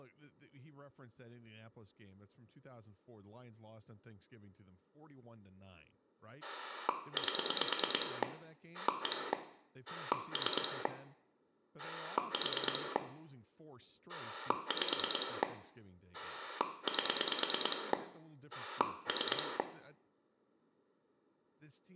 Pulse dialling, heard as a rotary dial, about 9 pulses a second, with room echo and speech in English. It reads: 8 1 3 4 5 8 3